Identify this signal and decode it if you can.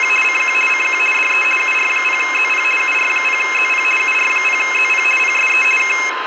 RTTY (50 baud, 450 Hz shift), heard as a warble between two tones, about 2350 Hz centre, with radio static, a steady whistle near 1030 Hz and room echo. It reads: … CQ CQ DE UR0ZP UR0ZP UR0ZP PSE K